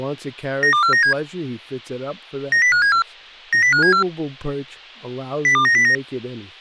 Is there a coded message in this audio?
Yes: five-tone selective call (CCIR) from 0.6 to 5.9 s, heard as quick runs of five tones, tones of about 100 ms, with speech in English. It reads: 92497 90574 90574 02909